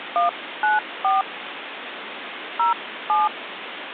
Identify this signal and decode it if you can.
DTMF, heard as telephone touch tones, dialled by hand, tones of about 170 ms, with phone line noise. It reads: 194 07